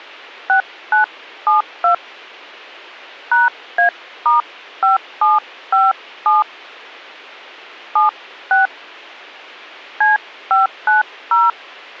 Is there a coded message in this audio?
Yes: DTMF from 0.5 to 11.5 s, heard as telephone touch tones, dialled by hand, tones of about 140 ms. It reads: 6972 #A*5757 76 C590